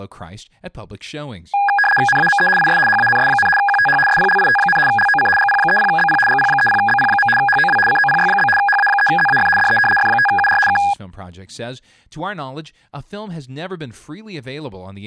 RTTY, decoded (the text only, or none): NAME IS HANS, QTH SPLIT, LOC GP30BP GP30BP. HOW COPY? HA3ZAF DE F5UR K